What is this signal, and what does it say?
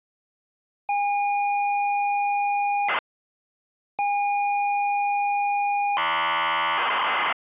ZX Spectrum tape loading, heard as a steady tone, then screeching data.